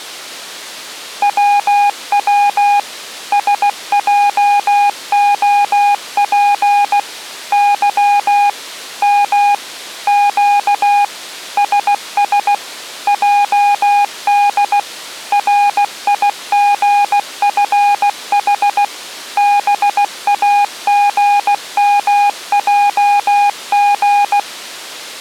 Morse code, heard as a keyed tone, machine-sent, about 16 wpm, 820 Hz. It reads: WW SJOP Y M Q SS JD RIGFH BAGMJG